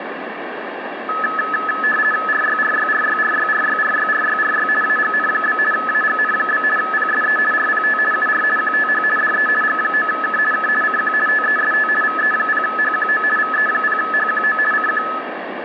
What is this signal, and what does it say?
RTTY (50 baud, 450 Hz shift), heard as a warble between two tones, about 1500 Hz centre, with radio static and room echo. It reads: RYRYRYRYRYRYRYRY AGN? AGN? PSE RPT UR QTH DE G9K K CQ TEST VE0HQO VE0HQO CQ